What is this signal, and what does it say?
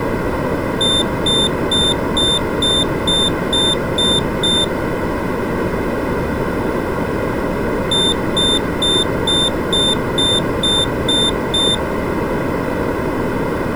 Beep code, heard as a piezo beeper, played twice, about 3600 Hz. 9 short. In AMI BIOS tables: ROM checksum failure.